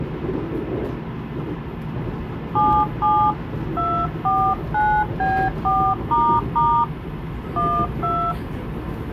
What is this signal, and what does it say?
DTMF, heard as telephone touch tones, dialled by hand, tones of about 280 ms, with the noise inside a subway train. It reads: 77 249B4** 12